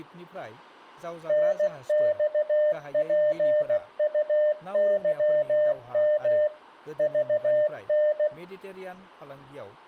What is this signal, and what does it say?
Morse code, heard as a keyed tone, machine-sent, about 16 wpm, 600 Hz, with speech in Bodo. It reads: NXPUYM VN